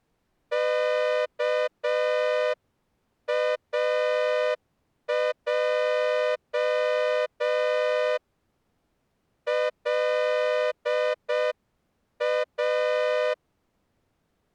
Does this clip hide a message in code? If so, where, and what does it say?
Yes: Morse code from 0.5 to 13.4 s, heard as a horn, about 6 wpm. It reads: KAJ LA